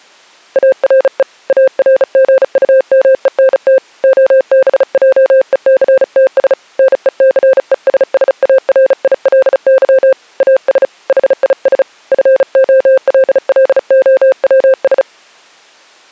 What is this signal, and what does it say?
Morse code, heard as a keyed tone, hand-sent with a bug key, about 35 wpm, 520 Hz. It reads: ARE ARGUMENT OBJECTS NECESSARILY AS HIS FOLLOWS